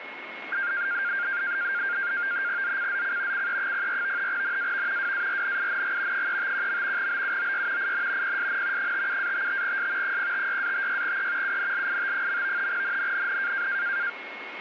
NAVTEX (SITOR-B), 100 baud, 170 Hz shift, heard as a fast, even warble, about 1500 Hz centre, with radio static and a steady whistle near 2170 Hz. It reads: ZCZC CE04 NAV WARNING 351. BUOY IN PSN 57-55S 056-56E UNLIT. NNNN